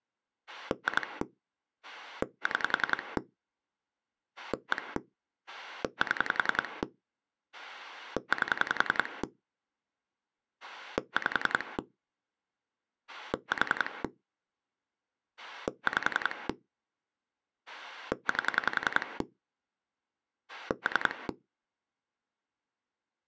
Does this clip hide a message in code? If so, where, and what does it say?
Yes: pulse dialling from 0.5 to 21.3 s, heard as a rotary dial, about 10 pulses a second. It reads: 2 6 1 7 8 5 4 5 8 3